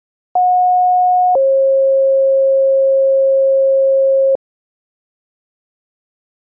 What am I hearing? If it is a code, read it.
Two-tone page, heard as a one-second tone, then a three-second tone, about 730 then 540 Hz.